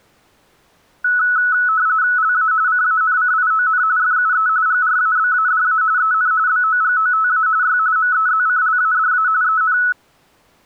RTTY (45.45 baud, 170 Hz shift), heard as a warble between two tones, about 1390 Hz centre. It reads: LA CANCION FUE GRABADA EN BOGOTA Y MEZCLADA EN